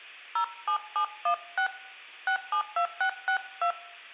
DTMF, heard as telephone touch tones, dialled by hand, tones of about 90 ms, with room echo. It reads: 07716 672662